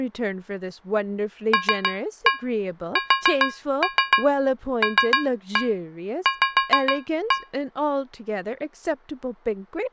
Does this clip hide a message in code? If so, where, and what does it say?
Yes: tap code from 1.5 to 7.6 s, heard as taps on a metal pipe, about 6 knocks a second, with speech in English. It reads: LSLV